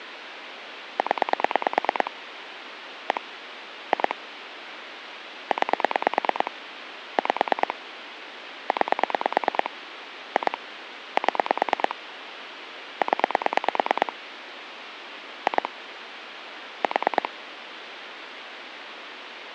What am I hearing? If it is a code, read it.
Pulse dialling, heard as clicks on a phone line, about 9 pulses a second, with phone line noise. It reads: 0 1 2 9 5 9 2 7 0 2 4